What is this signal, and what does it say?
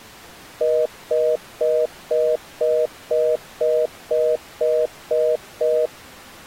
Telephone call progress tone (North American plan), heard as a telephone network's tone, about 480, 620 Hz, 0.25 s on and 0.25 s off. Congestion tone.